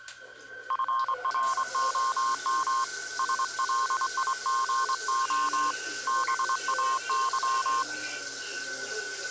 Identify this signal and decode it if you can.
Morse code, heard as a keyed tone, hand-sent with a straight key, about 24 wpm, 1060 Hz, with the noise of a restroom. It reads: FROM SLIGO BAY